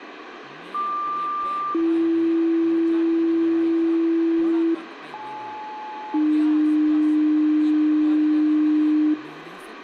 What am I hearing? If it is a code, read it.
Two-tone page, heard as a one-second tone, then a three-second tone, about 1180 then 330 Hz, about 860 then 300 Hz, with radio hiss, room echo and speech in Dogri.